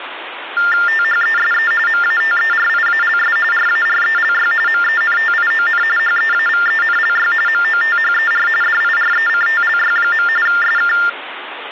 TTY/TDD text telephone tones (45.45 baud Baudot), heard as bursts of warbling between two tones, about 400 Hz shift, 1600 Hz centre, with phone line noise. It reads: THESE MATERIALS RARELY MENTION HEAVENLY MOTHER DIRECTLY. SK